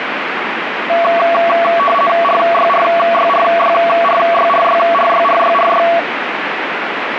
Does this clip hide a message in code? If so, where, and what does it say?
Yes: RTTY (50 baud, 450 Hz shift) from 0.9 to 6.0 s, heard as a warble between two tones, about 900 Hz centre, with radio static. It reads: RYRYRYRYRYRYRYRY